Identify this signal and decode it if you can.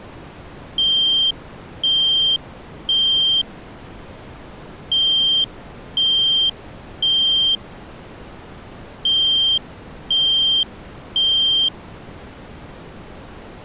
Alarm pattern, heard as an alarm's beeps, played three times, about 3150 Hz. Temporal three. Smoke or fire, evacuate.